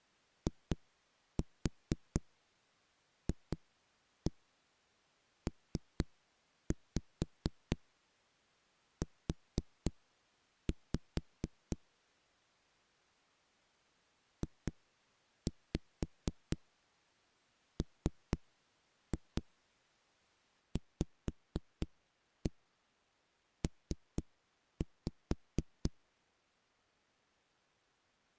Tap code, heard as knocks on a wall, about 4 knocks a second. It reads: IFPU JMVP